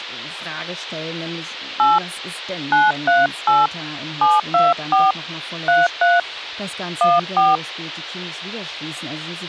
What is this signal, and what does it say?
DTMF, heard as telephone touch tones, dialled by hand, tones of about 190 ms, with speech in German. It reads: 8 938 724 33 14